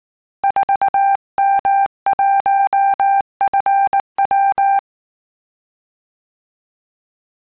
Morse code, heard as a keyed tone, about 19 wpm, 790 Hz. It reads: 4M1FW